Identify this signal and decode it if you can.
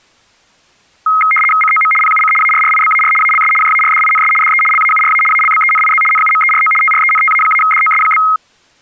RTTY (75 baud, 850 Hz shift), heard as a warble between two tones, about 1700 Hz centre. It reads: COM PUC ARRIBAR ALS JARDINS DE LAURA ALBENIZ NUMERO TRENTA-DOS?